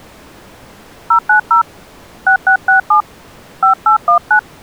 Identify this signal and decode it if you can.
DTMF, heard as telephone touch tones, dialled by hand, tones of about 110 ms. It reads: 090 6667 5819